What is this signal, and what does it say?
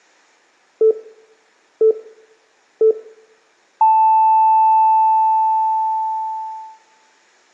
Radio time signal (three low pips and a long one an octave up, as on NHK), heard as pips, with room echo.